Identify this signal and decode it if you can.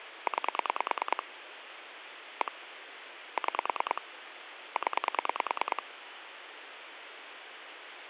Pulse dialling, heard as clicks on a phone line, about 9 pulses a second, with phone line noise. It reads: 9 1 6 0